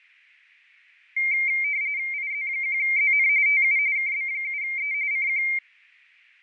RTTY (45.45 baud, 170 Hz shift), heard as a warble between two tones, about 2200 Hz centre, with fading. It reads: IZ1ZN TU KB7E CQ